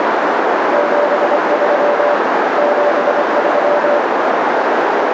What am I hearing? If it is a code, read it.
Morse code, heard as a keyed tone, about 24 wpm, 580 Hz, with heavy radio static and a narrow filter. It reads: 73 73